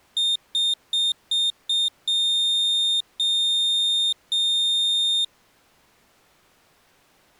Beep code, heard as a piezo beeper, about 3650 Hz. 5 short, 3 long.